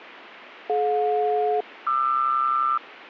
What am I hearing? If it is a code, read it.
Aircraft SELCAL, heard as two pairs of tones. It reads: DJ-QR